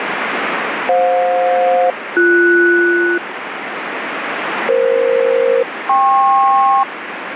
Aircraft SELCAL, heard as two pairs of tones, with radio static. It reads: FJ-BS EF-KP